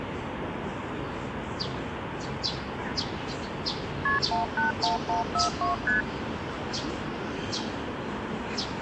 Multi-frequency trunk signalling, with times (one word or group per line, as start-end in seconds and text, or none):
4.1-4.2 KP
4.3-5.7 181142
5.9-6.0 ST